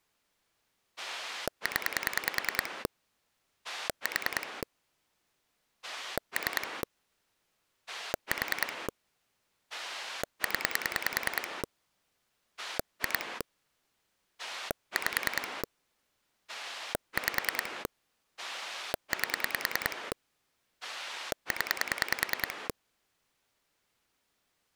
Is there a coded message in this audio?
Yes: pulse dialling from 1.0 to 22.7 s, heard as a rotary dial, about 10 pulses a second. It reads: 0 4 3 4 0 2 5 5 8 0